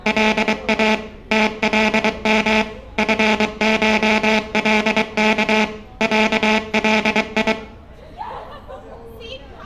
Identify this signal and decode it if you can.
Morse code (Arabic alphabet), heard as a buzzer, machine-sent, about 23 wpm, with room echo and street noise. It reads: لا تلم فشلك علي